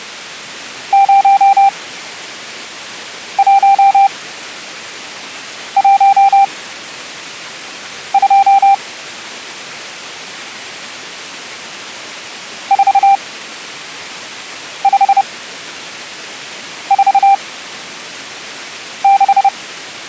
Morse code, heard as a keyed tone, machine-sent, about 30 wpm, spaced as for 5 wpm, 790 Hz. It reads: 0112 4546